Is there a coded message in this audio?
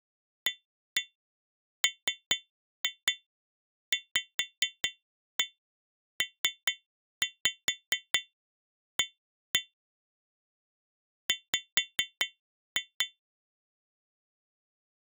Yes: tap code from 0.5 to 13.2 s, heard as taps on glass, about 4 knocks a second. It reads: AMVPA W